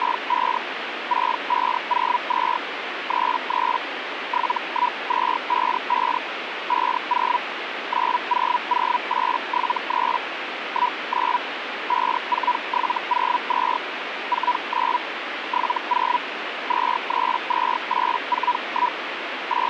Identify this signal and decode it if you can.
Hellschreiber (Feld-Hell, 122.5 baud), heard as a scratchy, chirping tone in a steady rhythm, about 980 Hz, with radio static. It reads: … 6502 33 71255 50 900873 19 54702 49 70 232841 …